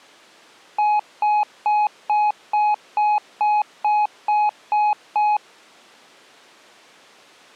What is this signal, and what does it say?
Beep code, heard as beeps, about 840 Hz. 11 short. In AMI BIOS tables: cache memory error.